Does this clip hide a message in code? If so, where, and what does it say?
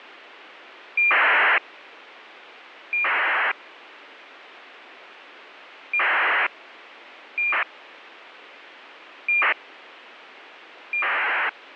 Yes: ACARS aircraft data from 1.0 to 11.5 s, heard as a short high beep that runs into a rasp, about 2400 baud, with radio hiss.